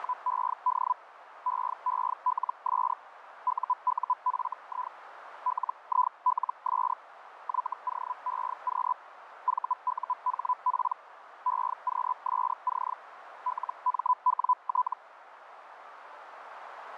Hellschreiber (Feld-Hell, 122.5 baud), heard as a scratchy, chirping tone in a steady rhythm, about 1000 Hz, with radio static and a narrow filter. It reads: … EELS UUFI LILS YOEQ VUHP EQSC LMWT